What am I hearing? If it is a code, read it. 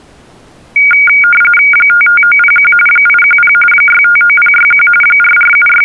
RTTY (45.45 baud, 850 Hz shift), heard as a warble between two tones, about 1850 Hz centre. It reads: 55901 810 659061 …